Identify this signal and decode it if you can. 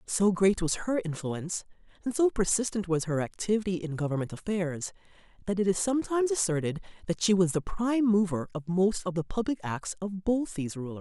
Speech in English. There is no code.